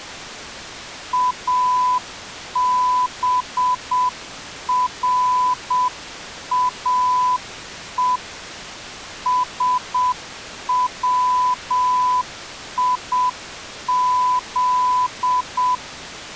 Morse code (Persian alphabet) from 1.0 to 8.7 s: ابراه

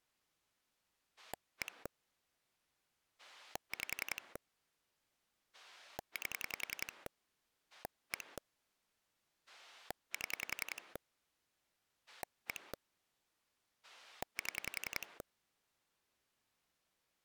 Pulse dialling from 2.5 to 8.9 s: 5 8 1

